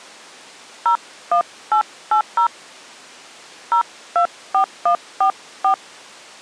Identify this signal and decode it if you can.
DTMF, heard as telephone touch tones, dialled by hand, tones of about 100 ms. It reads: 01880 024144